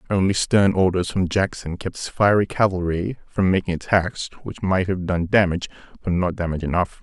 Speech in English. There is no code.